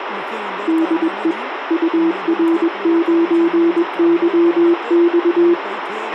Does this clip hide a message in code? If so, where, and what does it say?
Yes: Morse code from 0.6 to 5.6 s, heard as a keyed tone, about 21 wpm, 330 Hz, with radio hiss, a squelch burst at the end and speech in Sindhi. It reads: DE UR9YX